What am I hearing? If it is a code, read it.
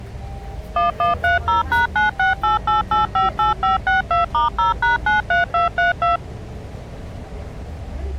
DTMF, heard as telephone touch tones, dialled by machine, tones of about 140 ms, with the noise inside a bus. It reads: 1130#9688858562*0#93232